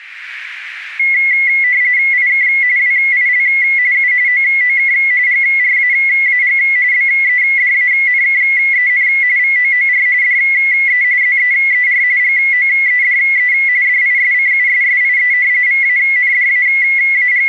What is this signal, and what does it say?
RTTY (45.45 baud, 170 Hz shift), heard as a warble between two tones, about 2050 Hz centre. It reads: IK WIL U OOK GRAAG BEDANKEN VOOR DE ZEER GOEDE DISCUSSIE …